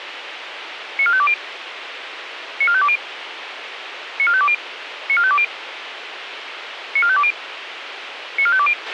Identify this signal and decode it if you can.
Five-tone selective call (ZVEI), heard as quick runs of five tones, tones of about 70 ms, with radio hiss and a squelch burst at the end. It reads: 94520 94520 94520 94520 94520 94520